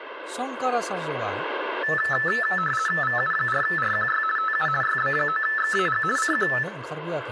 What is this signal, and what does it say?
RTTY (50 baud, 450 Hz shift), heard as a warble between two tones, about 1550 Hz centre, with speech in Bodo. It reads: VU4RQY TU YB9XAG CQ